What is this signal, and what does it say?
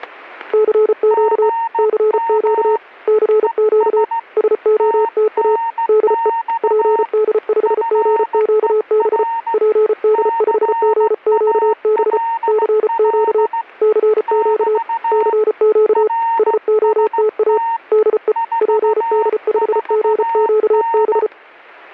Morse code, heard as two keyed tones, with static crashes. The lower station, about 34 wpm, 430 Hz: CQ CQ CQ SOTA DE PD5GQB PD5GQB CQ CQ CQ SOTA DE PD5GQB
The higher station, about 16 wpm, 920 Hz: GM ES TNX FER CALL <BT> RST 44N